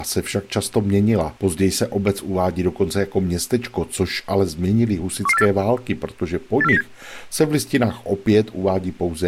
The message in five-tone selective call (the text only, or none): 11484 84097